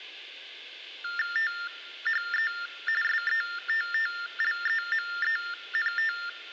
TTY/TDD text telephone tones (45.45 baud Baudot), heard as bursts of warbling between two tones, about 400 Hz shift, 1600 Hz centre. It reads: THE SETTLEMENT